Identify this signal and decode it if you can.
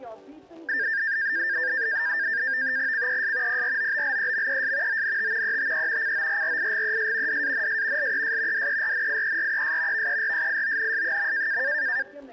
NAVTEX (SITOR-B), 100 baud, 170 Hz shift, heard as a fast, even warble, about 1700 Hz centre. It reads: CES PROBLEMES ONT ETE CORRIGES DANS LES DERNIERES VERSIONS.